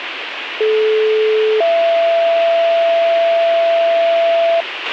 Two-tone page, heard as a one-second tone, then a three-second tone, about 430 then 670 Hz, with radio hiss and a squelch burst at the end.